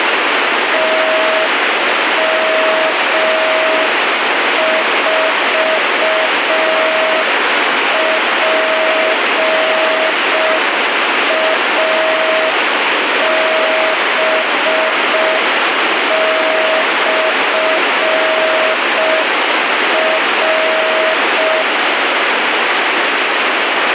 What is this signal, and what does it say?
Morse code, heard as a keyed tone, machine-sent, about 5 wpm, 640 Hz, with heavy radio static. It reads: TM4PAB/R